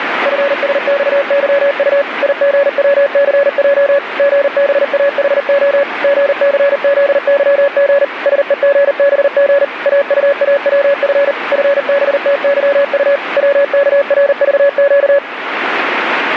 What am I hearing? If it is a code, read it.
Morse code, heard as a keyed tone, machine-sent, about 39 wpm, 560 Hz, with radio static. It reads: FSXYU IGWCJ GBAHO GCZYG SEGBG AUAWF FBTYU WKRVQ